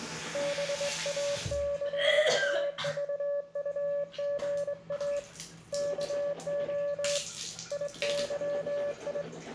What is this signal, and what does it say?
Morse code, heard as a keyed tone, hand-sent with a straight key, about 22 wpm, 570 Hz, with room echo and the noise of a restroom. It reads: BAKAVUGA KO IYI